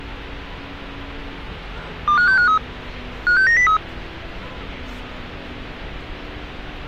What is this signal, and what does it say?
Five-tone selective call (CCIR), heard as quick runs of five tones, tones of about 100 ms, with street noise. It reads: 25653 56903